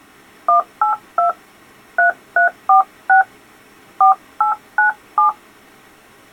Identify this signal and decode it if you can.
DTMF, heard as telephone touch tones, dialled by hand, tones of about 120 ms. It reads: 182 3346 4897